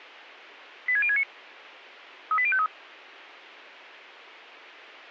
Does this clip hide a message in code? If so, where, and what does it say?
Yes: five-tone selective call (ZVEI) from 0.9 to 2.7 s, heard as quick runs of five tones, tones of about 70 ms. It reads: 86069 38053